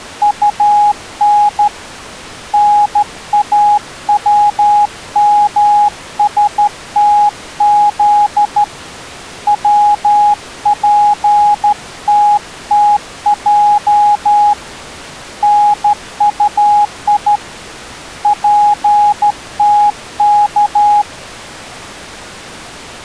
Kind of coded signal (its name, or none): Morse code